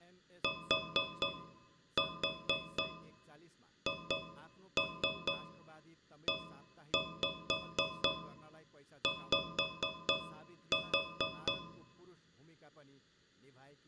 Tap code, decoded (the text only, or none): THEY